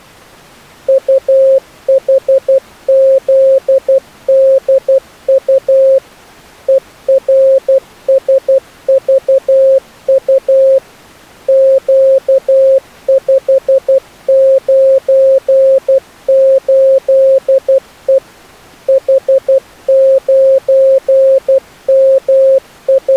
Morse code, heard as a keyed tone, machine-sent, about 12 wpm, 540 Hz. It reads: UHZDU ERSVU Q598E …